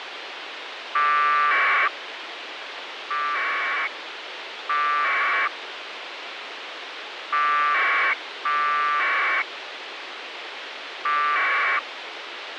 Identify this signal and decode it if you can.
Packet radio (AX.25, as in APRS), 1200 baud, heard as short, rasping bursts, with radio hiss.